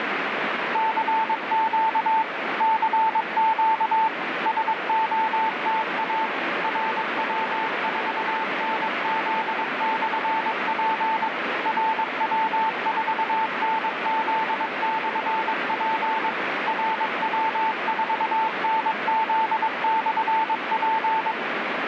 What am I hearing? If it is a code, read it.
Morse code, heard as a keyed tone, machine-sent, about 22 wpm, 890 Hz, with heavy radio static. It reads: CQ CQ SOTA RW4NZ/P RW4NZ/P RW4NZ/P